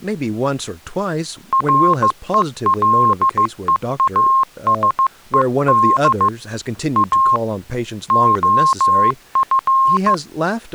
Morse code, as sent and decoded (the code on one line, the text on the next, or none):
.-. . .-.. . .- ... . -.. / .- / --- ..-.
RELEASED A OF